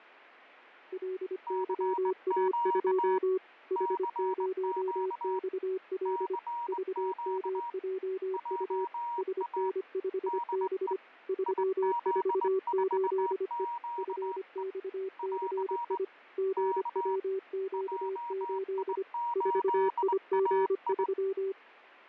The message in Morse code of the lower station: LYA2 H0XL VMJU SN5B 348E FXCI GWQ8 4IG3

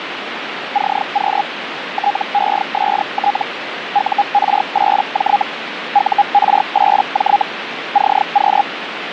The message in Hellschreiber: CQ TEST UR8J UR8J CQ

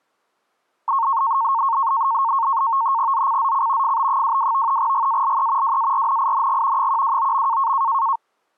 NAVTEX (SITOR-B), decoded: ZCZC FB22 GALE WARNING 129.

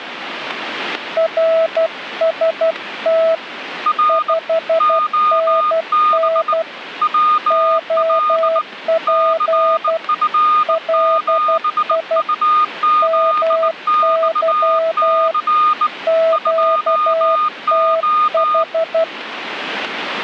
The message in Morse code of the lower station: RST 5NN OP LI MY QTH

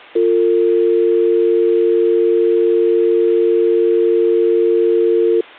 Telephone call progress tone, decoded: dial tone

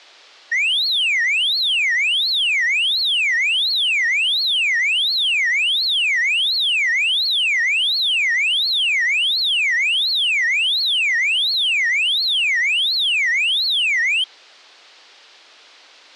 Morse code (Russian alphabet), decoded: none

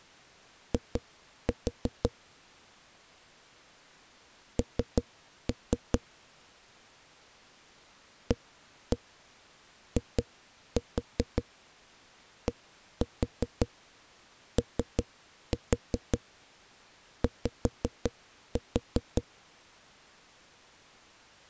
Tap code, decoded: I N AIDOY

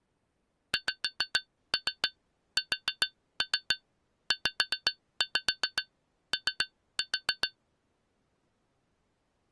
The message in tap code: XSZO

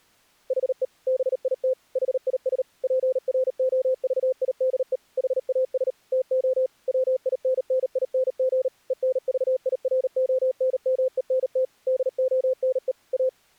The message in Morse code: HE BIT HIS PROVIDE HAS TO WINNING ENVIRONMENT DONE A

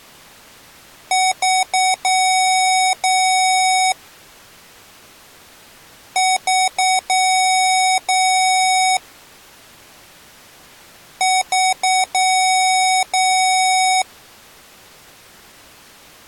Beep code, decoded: 3 short, 2 long

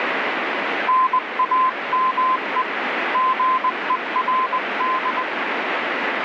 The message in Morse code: NAME GERD

